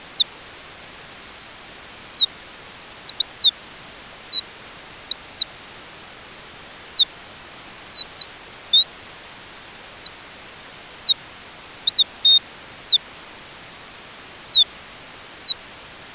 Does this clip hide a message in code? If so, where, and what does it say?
No, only bird-like chirps.